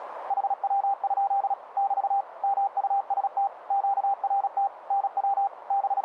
Morse code, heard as a keyed tone, machine-sent, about 36 wpm, 790 Hz, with radio static and a narrow filter. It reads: HW? <BT> MUST QRT NW …